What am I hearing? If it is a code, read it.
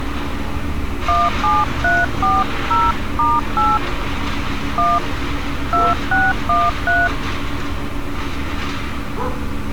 DTMF, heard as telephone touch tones, dialled by hand, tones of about 200 ms, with street noise. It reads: 17340*8 1 2613